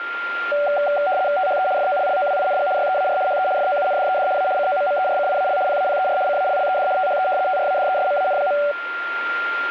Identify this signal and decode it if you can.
RTTY (75 baud, 170 Hz shift), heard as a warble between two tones, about 670 Hz centre, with radio static and a steady whistle near 1400 Hz. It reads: THE FOLLOWING YEAR HE FOUNDED A COMMERCIAL PAPER CALLED THE TRADESMAN.